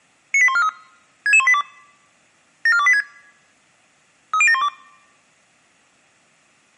Five-tone selective call (ZVEI), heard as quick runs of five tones, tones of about 70 ms. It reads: 98143 66182 74286 30712